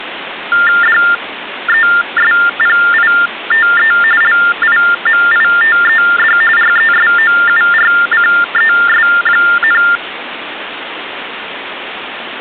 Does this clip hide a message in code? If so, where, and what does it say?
Yes: TTY/TDD text telephone tones (45.45 baud Baudot) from 0.5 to 10.0 s, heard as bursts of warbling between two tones, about 400 Hz shift, 1600 Hz centre, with phone line noise. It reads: DESPITE LIMITED RESOURCES,